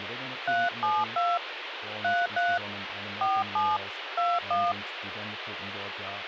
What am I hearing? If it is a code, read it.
DTMF, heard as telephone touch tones, dialled by hand, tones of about 210 ms, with radio hiss and speech in German. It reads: 372 33 47 21